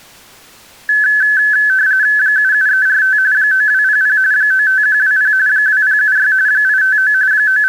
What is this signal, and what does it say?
RTTY (45.45 baud, 170 Hz shift), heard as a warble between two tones, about 1600 Hz centre. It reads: 77345 9200 95120 2076 859 …